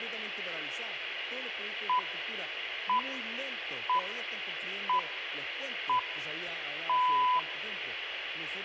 Radio time signal (six pips, as the Greenwich Time Signal), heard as pips, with room echo.